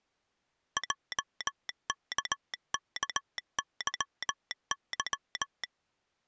Morse code, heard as a telegraph sounder, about 18 wpm. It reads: JKKYY